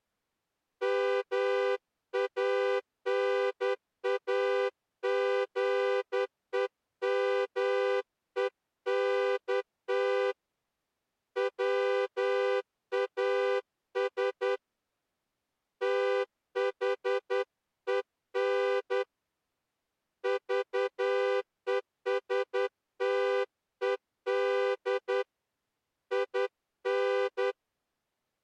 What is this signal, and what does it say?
Morse code, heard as a horn, hand-sent with a straight key, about 10 wpm. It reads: MANAGEMENT WAS THEN VESTED IN